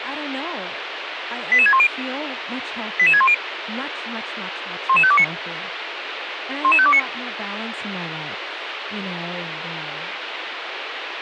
Five-tone selective call (ZVEI), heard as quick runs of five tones, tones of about 70 ms, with radio hiss and speech in English. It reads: 88610 88610 11529 11529